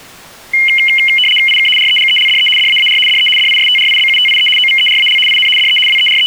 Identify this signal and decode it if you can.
RTTY (75 baud, 850 Hz shift), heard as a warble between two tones, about 2550 Hz centre. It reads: IK REGELDE DAAR DE DISTRIBUTIE OVERAL IN DE …